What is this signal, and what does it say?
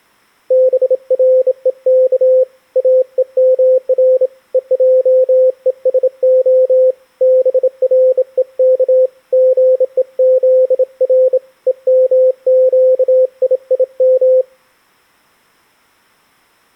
Morse code (Hebrew alphabet), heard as a keyed tone, hand-sent with a bug key, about 27 wpm, 520 Hz. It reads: ברוך אומר ועושה ברוך גוזר ומקיים